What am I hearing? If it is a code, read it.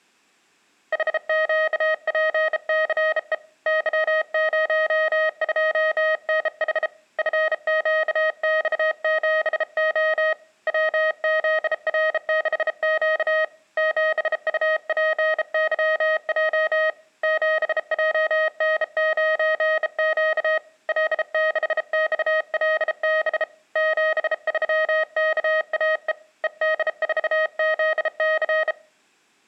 Morse code, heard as a keyed tone, hand-sent with a bug key, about 33 wpm, 630 Hz. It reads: HQPCE Y02NH FQX7O WZR6Q 7UPYJ 7JN9Q L6XLB 73KAE ED4ZC